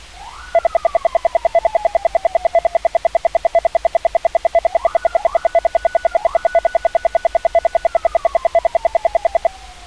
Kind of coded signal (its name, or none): radio time signal